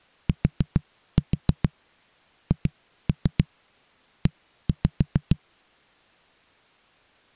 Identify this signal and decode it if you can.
Tap code, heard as knocks on a wall, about 6 knocks a second. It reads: THE